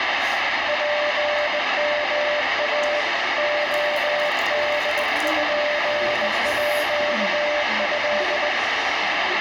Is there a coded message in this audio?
Yes: Morse code (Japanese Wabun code) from 0.6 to 8.5 s, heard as a keyed tone, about 20 wpm, 590 Hz, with radio static, room echo and the noise of a restaurant. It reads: ツヨイ レポート